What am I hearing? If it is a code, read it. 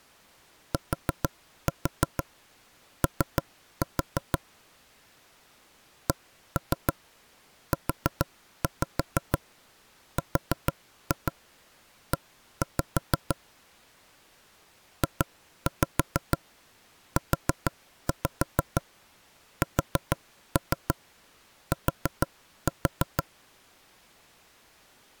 Tap code, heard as knocks on wood, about 6 knocks a second. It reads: TO CURE JUST